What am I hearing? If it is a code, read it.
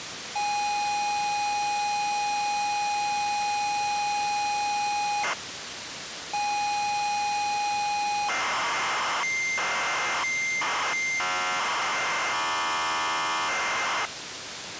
ZX Spectrum tape loading, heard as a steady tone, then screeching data, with tape hiss.